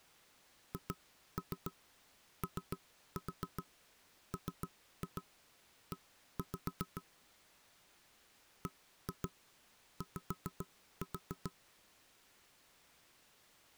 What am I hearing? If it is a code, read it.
Tap code, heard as knocks on wood, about 7 knocks a second. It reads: HOME BY